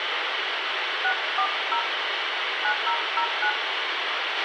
DTMF, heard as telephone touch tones, dialled by hand, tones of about 80 ms, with radio hiss, a squelch burst at the end and room echo. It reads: 640 9009